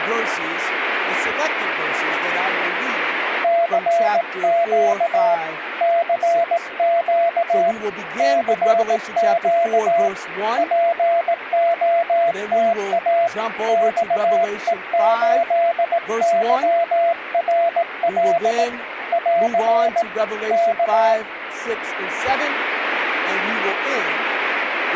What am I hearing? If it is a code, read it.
Morse code, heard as a keyed tone, hand-sent with a paddle, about 18 wpm, 680 Hz, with radio static. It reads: CQ CQ CQ POTA XE8YRL <AR> K